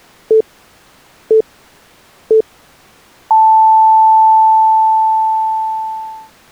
Radio time signal (three low pips and a long one an octave up, as on NHK), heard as pips.